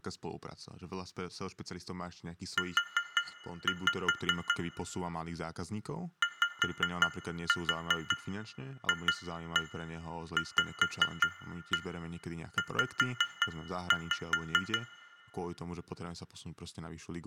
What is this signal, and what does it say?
Tap code, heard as taps on glass, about 5 knocks a second, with room echo and speech in Slovak. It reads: U YFVZ